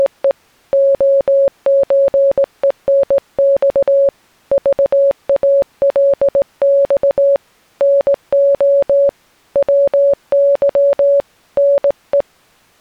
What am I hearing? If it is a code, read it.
Morse code (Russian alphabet), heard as a keyed tone, hand-sent with a straight key, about 18 wpm, 560 Hz. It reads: … ОЧЕНЬ ЖАЛЬ НО ВЫ НЕ